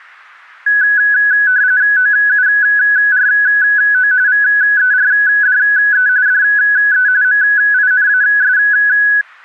RTTY (45.45 baud, 170 Hz shift), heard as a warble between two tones, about 1600 Hz centre. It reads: OURO VERDE DE MINAS